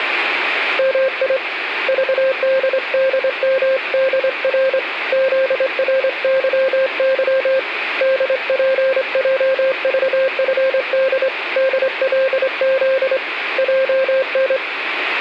Morse code, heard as a keyed tone, hand-sent with a straight key, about 25 wpm, 530 Hz, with radio static and room echo. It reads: MI VDDMDR ZRYY DPJVFD DLZ JN